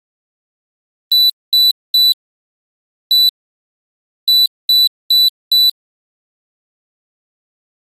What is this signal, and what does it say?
Beep code, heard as a piezo beeper, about 3950 Hz. 3-1-4. In Phoenix BIOS tables: interrupt mask register failure.